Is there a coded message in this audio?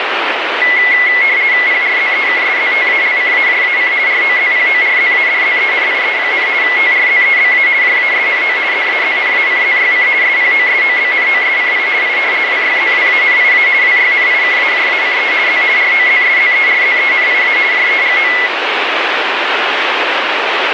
Yes: RTTY (50 baud, 170 Hz shift) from 0.6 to 18.5 s, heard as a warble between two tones, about 2050 Hz centre, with radio static. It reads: PRZEKSZTALCAJAC ROZPORZADZENIE, TRZEBA JASNO ZAZNACZYC SPOSOBNOSCI I WYZWANIA WYNIKAJACE Z ROZSZERZENIA JEGO